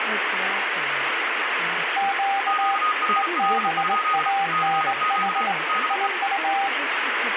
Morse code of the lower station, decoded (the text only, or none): Q EBANH IU